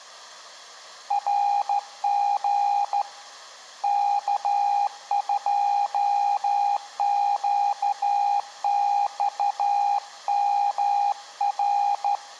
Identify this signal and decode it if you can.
Morse code, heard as a keyed tone, hand-sent with a straight key, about 13 wpm, 810 Hz, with room echo. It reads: RG K2QXMR